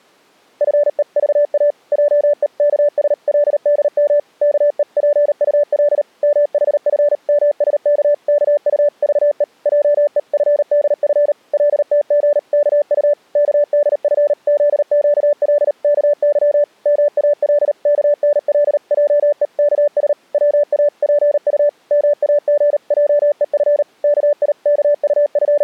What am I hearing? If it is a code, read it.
Morse code (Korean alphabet), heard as a keyed tone, machine-sent, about 38 wpm, 580 Hz. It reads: 나로 하여금 아직 문명이라 하는 것이 은택에 목욕하여 보지 못한 …